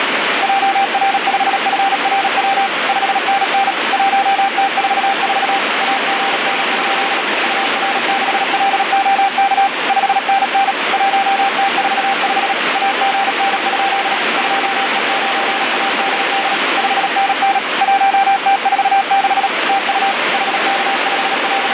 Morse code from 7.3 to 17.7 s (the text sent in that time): UR6LOK 5NN 1T45 AGN? 2E9ADD 5NN